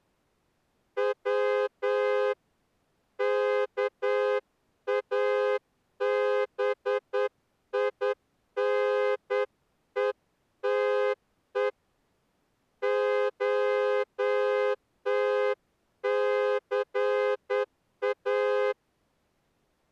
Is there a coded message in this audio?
Yes: Morse code (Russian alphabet) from 0.9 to 18.8 s, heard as a horn, hand-sent with a straight key, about 9 wpm. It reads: В КАБИНЕТЕ ОТЦА